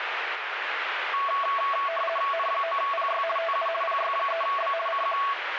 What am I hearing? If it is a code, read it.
RTTY (50 baud, 450 Hz shift), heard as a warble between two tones, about 890 Hz centre, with radio static. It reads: N9PY TU PY3B CQ